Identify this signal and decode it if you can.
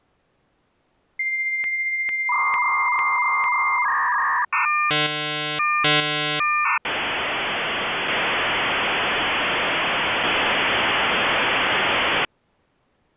Dial-up modem handshake (V.34 or later), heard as a whistle, warbles, then hiss.